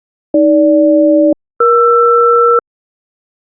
Aircraft SELCAL, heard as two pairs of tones. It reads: AG-ER